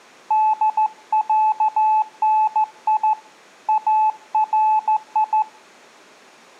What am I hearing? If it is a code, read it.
Morse code (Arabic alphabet), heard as a keyed tone, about 14 wpm, 860 Hz. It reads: دعني اري